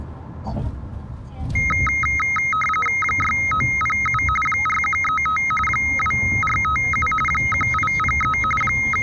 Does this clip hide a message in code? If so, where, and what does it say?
Yes: RTTY (45.45 baud, 850 Hz shift) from 1.6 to 9.0 s, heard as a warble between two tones, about 1700 Hz centre, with the noise inside a car. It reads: 6907 4135 2457 1803 …